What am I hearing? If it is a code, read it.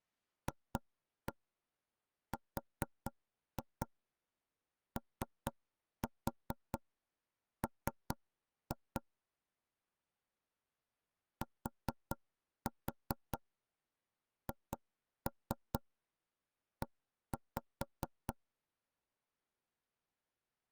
Tap code, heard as knocks on wood, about 4 knocks a second. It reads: FROM THE